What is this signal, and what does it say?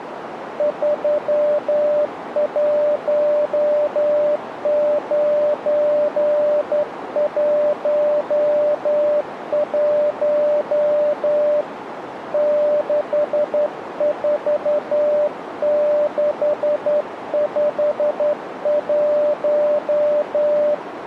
Morse code, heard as a keyed tone, hand-sent with a straight key, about 11 wpm, 590 Hz, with radio static and a narrow filter. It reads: 31911 64651